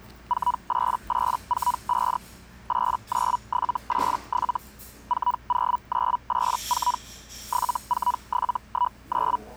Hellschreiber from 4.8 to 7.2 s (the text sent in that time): 40984